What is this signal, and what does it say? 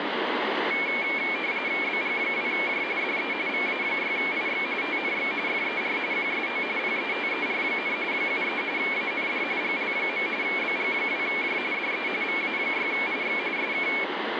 RTTY (45.45 baud, 170 Hz shift), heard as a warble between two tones, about 2300 Hz centre, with radio static. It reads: BG2J DE VA6IX TNX FER QSO PETER, 73 AND GL. BG2J DE VA6IX SK